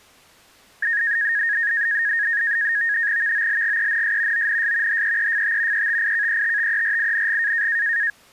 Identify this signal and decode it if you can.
NAVTEX (SITOR-B), 100 baud, 170 Hz shift, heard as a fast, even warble, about 1750 Hz centre. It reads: VOLGENS ONS HEEFT ETIKETTERING